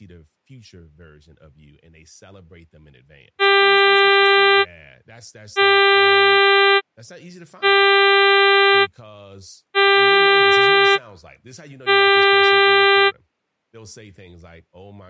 Ship horn signal, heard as a ship's horn, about 400 Hz, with speech in English. 5 short. At sea: I doubt that you are doing enough to avoid a collision.